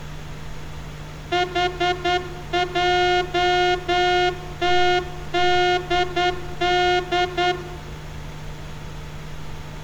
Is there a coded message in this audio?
Yes: Morse code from 1.3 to 7.6 s, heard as a horn, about 10 wpm, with room echo and street noise. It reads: HJTDD